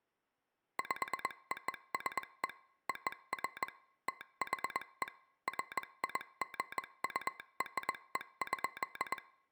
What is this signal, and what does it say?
Morse code (American railroad code), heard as a telegraph sounder, machine-sent. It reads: POSE OF THE FIGURE.